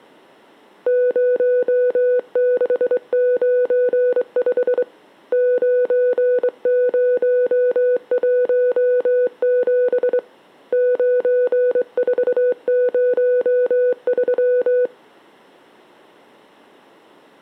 Morse code, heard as a keyed tone, hand-sent with a straight key, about 23 wpm, 500 Hz. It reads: 0695 9017 9403